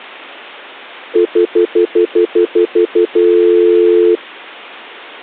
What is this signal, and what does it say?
Telephone call progress tone (North American plan), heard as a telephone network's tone, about 350, 440 Hz, 0.1 s on and 0.1 s off. Stutter dial tone.